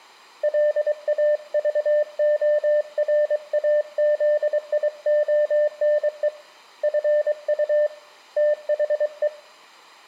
Morse code, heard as a keyed tone, hand-sent with a paddle, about 23 wpm, 600 Hz, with room echo. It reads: LAVORAZIONE FU THE